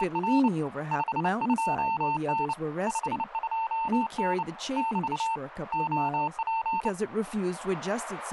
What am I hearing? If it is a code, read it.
Morse code, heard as a keyed tone, hand-sent with a bug key, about 29 wpm, 900 Hz, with radio static and speech in English. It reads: … 52N 52N <BT> OP